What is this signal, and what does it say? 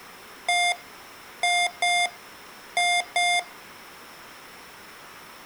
Beep code, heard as beeps from a small speaker, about 710 Hz, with room echo. 1-2-2. In Phoenix BIOS tables: DMA initialisation failure.